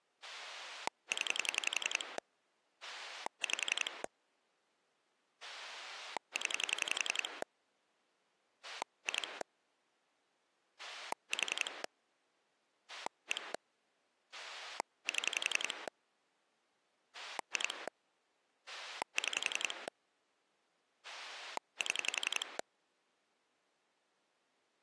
Pulse dialling, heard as a rotary dial, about 11 pulses a second. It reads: 0 5 0 2 4 1 7 2 6 7